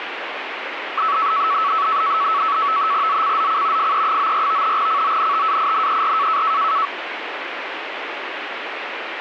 NAVTEX (SITOR-B), 100 baud, 170 Hz shift, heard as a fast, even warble, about 1220 Hz centre, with radio static. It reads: ZCZC FE94 CONTAINER